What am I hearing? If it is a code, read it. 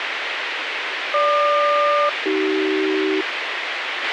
Aircraft SELCAL, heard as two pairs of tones, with radio hiss and a squelch burst at the end. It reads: GQ-AC